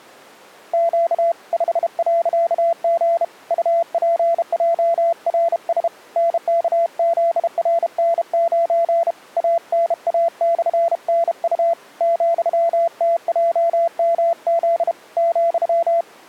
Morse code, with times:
0.7-1.3 Q
1.5-3.2 5.G
3.5-5.9 UPJRS
6.2-9.1 NKZRN9
9.4-11.7 ANA/NU
12.0-14.9 ,TJMZ
15.2-16.0 ,

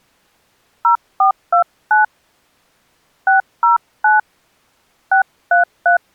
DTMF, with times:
0.8-2.0 0429
3.3-4.2 609
5.1-6.0 633

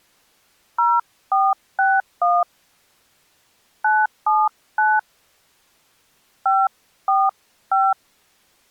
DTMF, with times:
0.8-2.4 0461
3.8-5.0 979
6.5-7.9 545

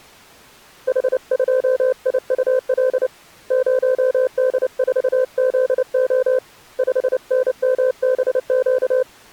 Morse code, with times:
0.9-3.1 H2IUL
3.5-6.4 0D4ZO
6.8-9.0 5NMBQ

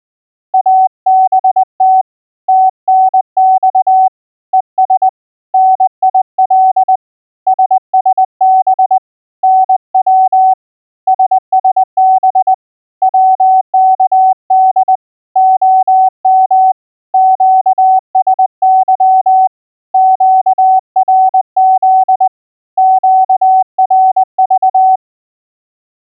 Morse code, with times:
0.5-2.0 ABT
2.5-4.1 TNX
4.5-5.1 ES
5.5-7.0 NIL
7.5-9.0 SSB
9.4-10.5 NW
11.1-12.5 SSB
13.0-15.0 WKD
15.4-16.7 OM
17.1-19.5 QSY
19.9-22.3 QRZ
22.8-25.0 QRV

